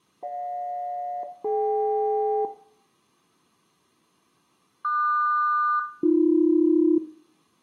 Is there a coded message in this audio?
Yes: aircraft SELCAL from 0.2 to 7.0 s, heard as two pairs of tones, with room echo. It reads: GJ-DK QS-AB